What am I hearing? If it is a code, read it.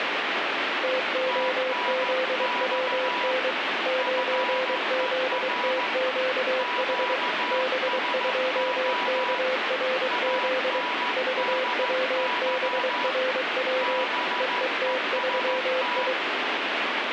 Morse code, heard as two keyed tones, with heavy radio static. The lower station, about 23 wpm, 520 Hz: TOZWN 9ZTQH B2KRZ VWBRW EET3I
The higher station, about 14 wpm, 980 Hz: TNX FER QSO ANDY BEST